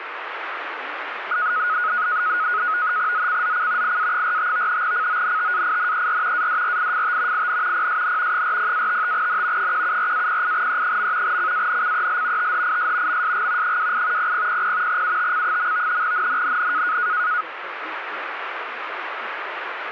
NAVTEX (SITOR-B), 100 baud, 170 Hz shift, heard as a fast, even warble, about 1360 Hz centre, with radio static. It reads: ZCZC IA45 CONTAINER ADRIFT IN PSN 40-55N 174-08E. CANCEL THIS MSG 28 0000 UTC. NNNN